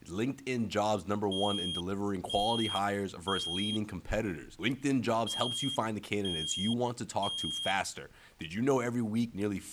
Alarm pattern, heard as an alarm's beeps, played twice, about 3250 Hz, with speech in English. Temporal three. Smoke or fire, evacuate.